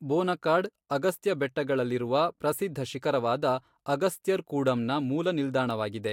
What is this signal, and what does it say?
Speech in Kannada. There is no code.